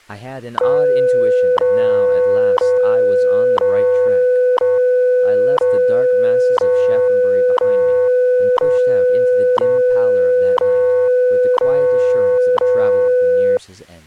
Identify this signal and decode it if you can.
Radio time signal (WWV, Colorado), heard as ticks, one a second, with speech in English.